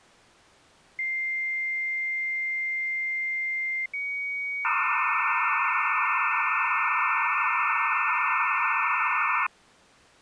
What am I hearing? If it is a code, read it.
Dial-up modem handshake (low-speed, two carriers), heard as two whistles, then hiss.